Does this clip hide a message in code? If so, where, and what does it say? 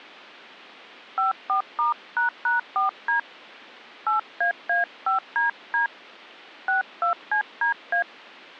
Yes: DTMF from 1.2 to 8.0 s, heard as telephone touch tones, dialled by hand, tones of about 120 ms. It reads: 54*##4D 8AA5DD 62CDA